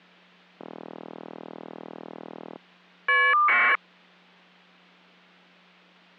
Caller ID data burst, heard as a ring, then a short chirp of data, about 1200 baud.